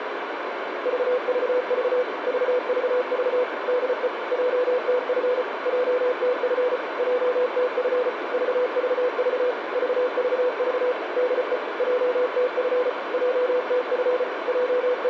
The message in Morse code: VVV VVV DE JTF JTF JTF VVV VVV DE JTF JTF …

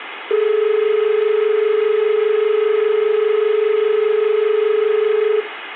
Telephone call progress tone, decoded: dial tone

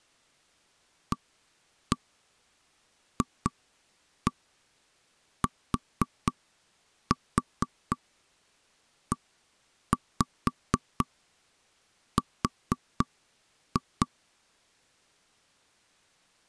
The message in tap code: AFTER

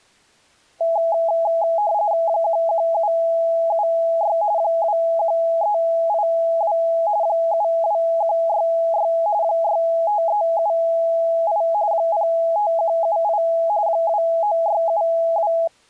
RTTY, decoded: 11776 21382 72166 65378 05178 29672

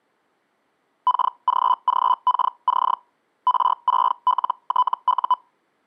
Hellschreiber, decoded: KGGKC R6LTU

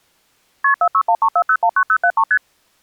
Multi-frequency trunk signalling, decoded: KP 46134019073 ST

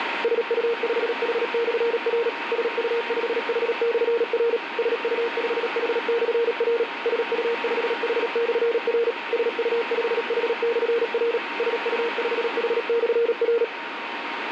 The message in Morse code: SU5H/R SU5H/R SU5H/R SU5H/R SU5H/R SU5H/R

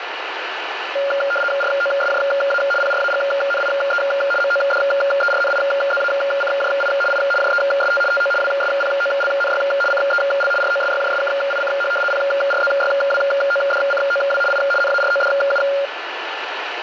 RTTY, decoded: ROSJA PRAGNIE MODERNIZACJI I JEST TO WSPOLNY CEL ROSYJSKICH PRZYWODCOW I NARODU

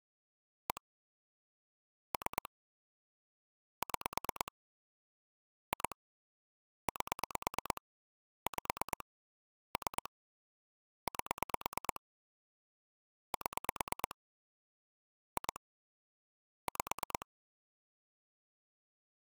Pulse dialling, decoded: 1 3 6 2 8 5 3 8 7 2 5

